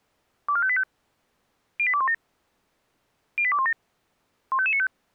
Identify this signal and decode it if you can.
Five-tone selective call (ZVEI), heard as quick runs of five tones, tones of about 70 ms. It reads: 24585 08217 08217 15595